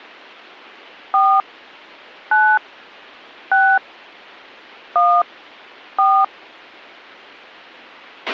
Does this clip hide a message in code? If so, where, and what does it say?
Yes: DTMF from 1.1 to 6.2 s, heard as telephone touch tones, dialled by hand, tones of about 260 ms, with a squelch burst at the end. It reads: 4 9 6 1 4